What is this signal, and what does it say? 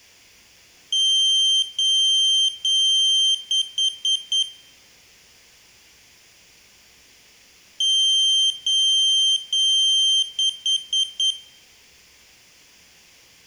Beep code, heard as a piezo beeper, played twice, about 3150 Hz, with room echo. 3 long, 4 short.